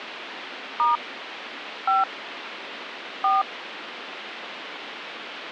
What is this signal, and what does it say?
DTMF, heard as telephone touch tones, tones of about 160 ms, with phone line noise. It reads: * 5 4